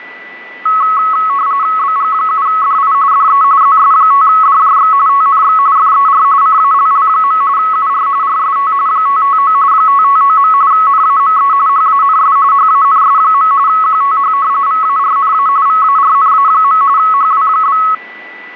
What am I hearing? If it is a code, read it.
RTTY (45.45 baud, 170 Hz shift), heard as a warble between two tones, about 1200 Hz centre, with a steady whistle near 1980 Hz. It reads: BG7DI DE ZS5DJX TNX FER CALL. UR RST 559 559. NAME HANS HANS. QTH VARNA VARNA. HW?